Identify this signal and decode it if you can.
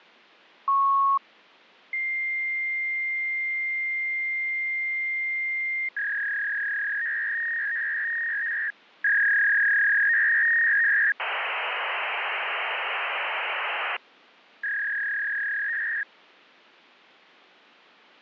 Fax machine handshake, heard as a beep, a long tone, a warble and hiss.